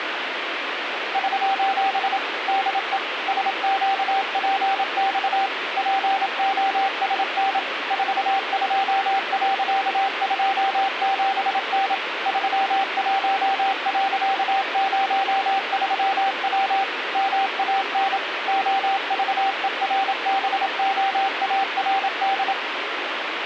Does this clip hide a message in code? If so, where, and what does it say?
Yes: Morse code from 1.1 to 22.6 s, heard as a keyed tone, machine-sent, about 27 wpm, 780 Hz, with radio static. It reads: <SOS> DE SQPX POSN 42.27N 31.03W MAN OVERBOARD